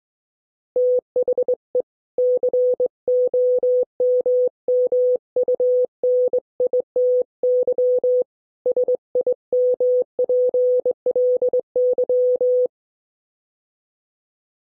Morse code, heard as a keyed tone, hand-sent with a straight key, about 22 wpm, 500 Hz. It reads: THE COMMUNITY SIMPLY